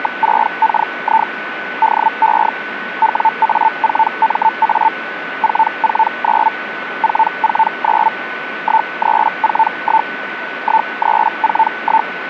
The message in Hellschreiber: … DE WA4MA 449 449 1341 1341

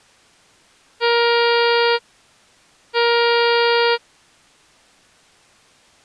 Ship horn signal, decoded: 2 short

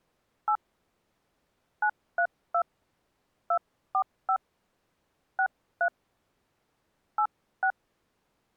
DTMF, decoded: 8 932 245 63 86

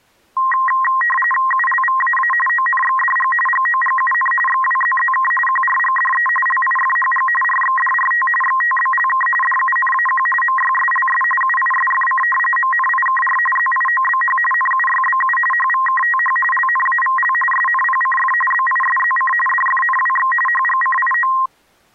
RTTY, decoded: ULVAA ONXDG GOGUN XWZZK QRGDE LIFHG RXDRT XTBLK DUNAQ MYSLS UISFC MNIKR ZIOBH NUYBU HVKTH LNAVL SNPCF BISZC DFNWX HGCIO

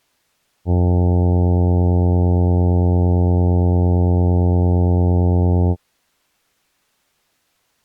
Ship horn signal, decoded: 1 long

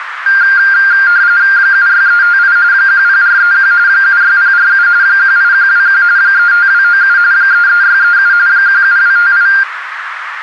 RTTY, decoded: 76358 10431 76047 18121 35297 33637 17258

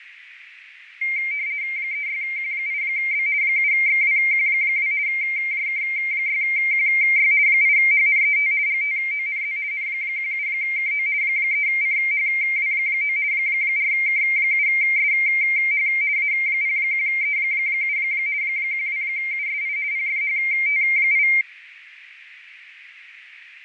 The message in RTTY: 36Q8B 7XWQ2 JK6QY 8HNET GTONZ N17KO 3CHW9 4K7SH A01E7 12USI PFHT8

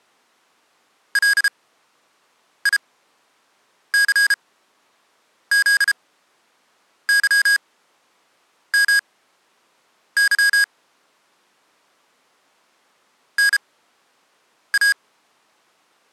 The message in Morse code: LICZYMY NA

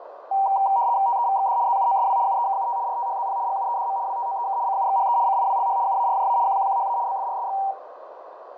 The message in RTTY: TEVXD ZUOSW UEKUT RTHZP GUEDM WTOEK CUXHE CIWLH UARJA QQQHA BFRSX

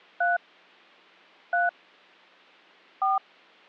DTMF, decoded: 3 3 4

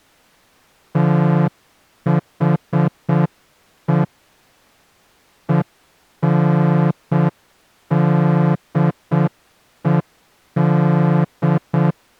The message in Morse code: THE ENDED

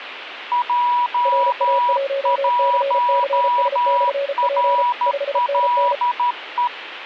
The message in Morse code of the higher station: J1RLE

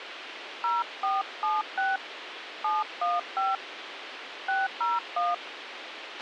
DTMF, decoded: 0476 715 601

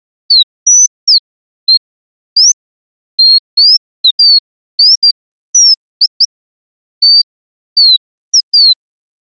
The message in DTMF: none

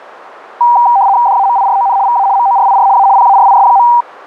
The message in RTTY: DAMIRON VA MORIR A PARIS.

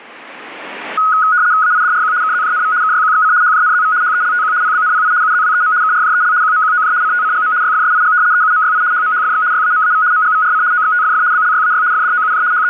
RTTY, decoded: AIDRQ KZJNV KYQXC HJNZV HELTQ PBNPI UZWEM KRJEL QMQOJ CTCGM YFSIG EUMYI HMHFX YAMAV MGVRC OXTFF BLYAY FDOUJ …

